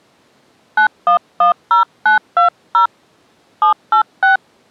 DTMF, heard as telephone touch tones, dialled by hand, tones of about 120 ms. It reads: 9110920 786